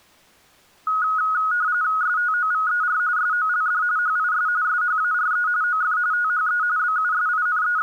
RTTY (45.45 baud, 170 Hz shift), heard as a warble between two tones, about 1360 Hz centre. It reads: STOVER SOLD HIS SHARE OF THE …